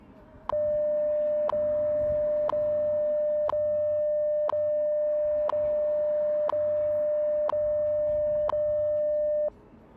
Radio time signal (WWV, Colorado), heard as ticks, one a second, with street noise.